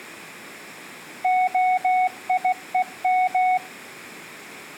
Morse code (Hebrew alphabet), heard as a keyed tone, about 16 wpm, 740 Hz, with room echo. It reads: היום